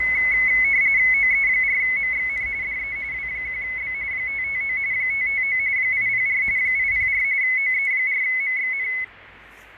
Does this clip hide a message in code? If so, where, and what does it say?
Yes: RTTY (45.45 baud, 170 Hz shift) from 0.0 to 9.0 s, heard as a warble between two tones, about 2100 Hz centre, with radio static, fading and street noise. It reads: OE4MXN DE W1B 559 559 804 804 OE4MXN